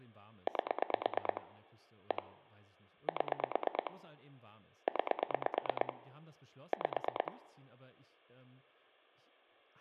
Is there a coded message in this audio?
Yes: pulse dialling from 0.5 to 7.3 s, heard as clicks on a phone line, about 9 pulses a second, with speech in German. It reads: 8 1 7 9 5